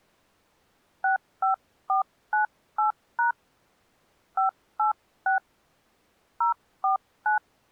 DTMF, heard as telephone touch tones, dialled by hand, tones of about 120 ms. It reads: 65498# 586 049